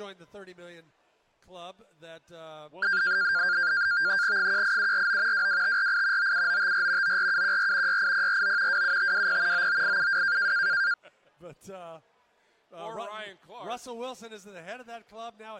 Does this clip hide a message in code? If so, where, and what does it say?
Yes: NAVTEX (SITOR-B), 100 baud, 170 Hz shift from 2.8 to 10.9 s, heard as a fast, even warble, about 1500 Hz centre. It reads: 18749 22548 97954 94714 68049 27520 99872